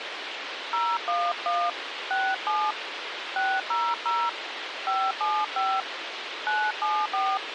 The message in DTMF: 011 67 600 575 974

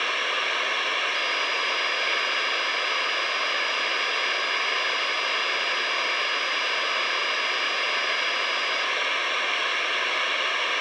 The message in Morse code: none

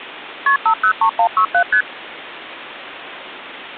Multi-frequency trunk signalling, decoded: KP 503167 ST

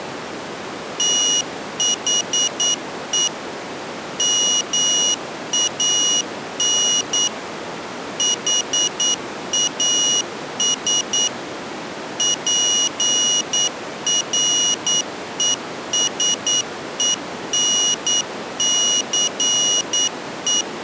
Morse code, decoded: THE MAN HAS PRESENCE

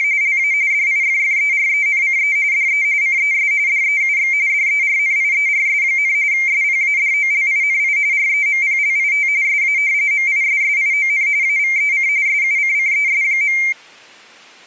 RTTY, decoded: … LA DIFFERENCE DE CES DEUX DERNIERS, SPADOLINI REMPLIT SA MISSION AVEC SUCCES.

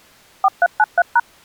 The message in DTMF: 4393#

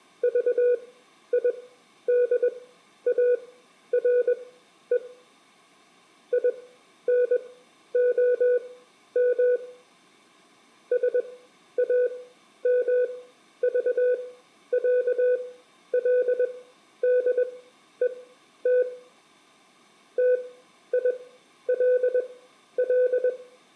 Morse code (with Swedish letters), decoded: VIDARE INOM SAMVÄLDET TILL

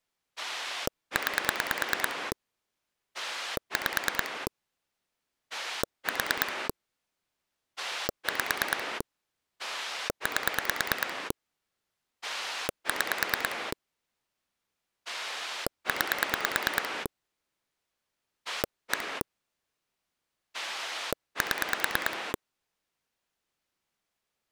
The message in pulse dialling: 9 5 4 5 8 6 9 1 7

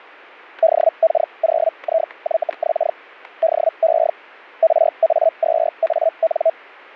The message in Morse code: none

